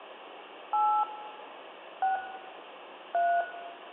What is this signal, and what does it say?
DTMF, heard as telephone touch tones, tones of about 220 ms, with phone line noise and room echo. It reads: 8 6 3